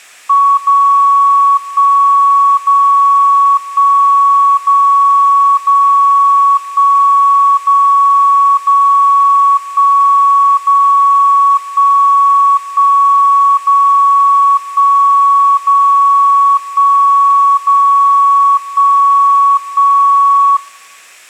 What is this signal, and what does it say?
Radio time signal (DCF77), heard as a tone whose level steps once a second, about 1120 Hz. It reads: 0 1 0 1 0 0 1 0 0 1 0 1 1 0 1 0 1 0 1 1